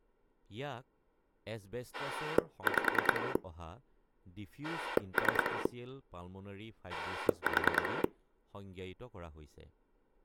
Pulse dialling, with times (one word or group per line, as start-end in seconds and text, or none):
1.9-3.4 5
4.6-5.7 3
6.9-8.0 4